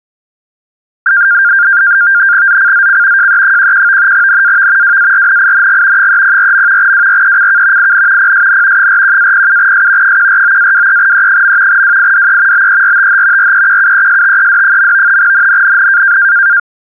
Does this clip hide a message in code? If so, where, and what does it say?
Yes: NAVTEX (SITOR-B), 100 baud, 170 Hz shift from 1.1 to 16.6 s, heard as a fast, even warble, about 1500 Hz centre. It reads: ZCZC JE11 NAV WARNING 304. WRECK IN PSN 41-07S 149-23E. WIDE BERTH REQUESTED. NNNN